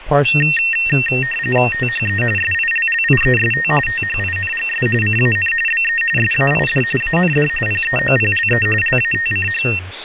RTTY (45.45 baud, 850 Hz shift), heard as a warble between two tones, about 2250 Hz centre, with radio static and speech in English. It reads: THE SILLIEST THINGS CAN BE SAID AND PEOPLE LATCH